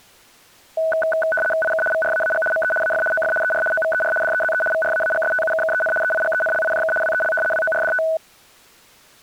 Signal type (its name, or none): RTTY